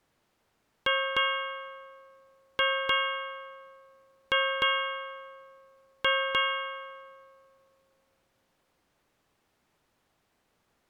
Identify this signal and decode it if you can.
Ship's bell, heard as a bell. 8. Eight half-hours of the watch have passed.